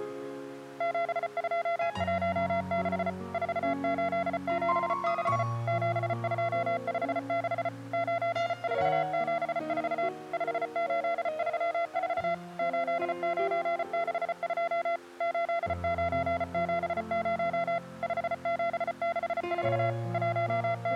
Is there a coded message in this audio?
Yes: Morse code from 0.7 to 21.0 s, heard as a keyed tone, machine-sent, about 34 wpm, 680 Hz. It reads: 7216 4876 7256 9474 5834 8962 8970 5764 …